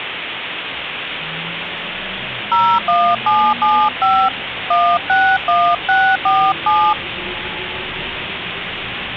DTMF, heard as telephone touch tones, dialled by hand, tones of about 270 ms, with phone line noise and the noise inside a subway train. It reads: 01775 161647